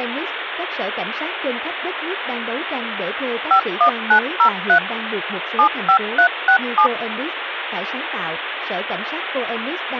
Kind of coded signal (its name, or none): DTMF